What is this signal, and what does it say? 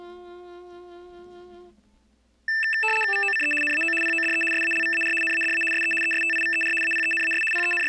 RTTY (75 baud, 850 Hz shift), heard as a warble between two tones, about 2200 Hz centre. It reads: VOCE NAO PODE SALVAR NADA SE ESTIVER APENAS …